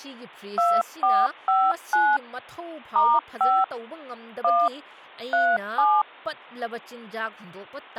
DTMF, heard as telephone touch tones, dialled by machine, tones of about 240 ms, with speech in Manipuri. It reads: 2459 *5 1 37